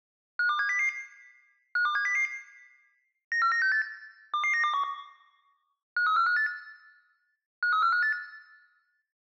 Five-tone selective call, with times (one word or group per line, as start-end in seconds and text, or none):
0.4-0.9 52700
1.8-2.3 52700
3.3-3.8 94968
4.3-4.8 22921
6.0-6.5 53458
7.6-8.1 53458